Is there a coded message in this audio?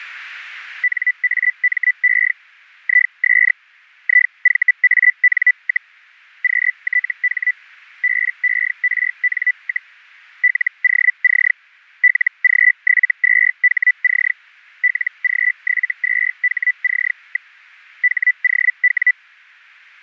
Yes: Hellschreiber (Feld-Hell, 122.5 baud) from 0.8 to 19.1 s, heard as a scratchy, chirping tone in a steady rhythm, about 2000 Hz. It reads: NAME IS IVAN, QTH BERN, LOC LG72HC LG72HC. HOW